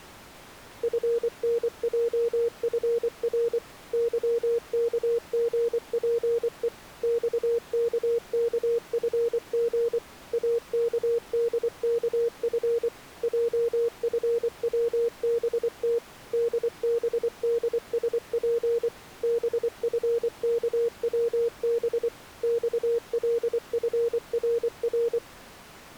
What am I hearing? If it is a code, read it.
Morse code, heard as a keyed tone, machine-sent, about 24 wpm, 470 Hz. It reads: FNJFR YKGPE XKKFG AKDKF JFWBT DBDSP BFKWB XLFRR